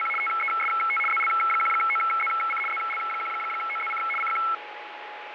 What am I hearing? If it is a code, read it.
RTTY (75 baud, 850 Hz shift), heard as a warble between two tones, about 1750 Hz centre, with radio static and a steady whistle near 840 Hz. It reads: … TEST ZL1OZC ZL1OZC CQ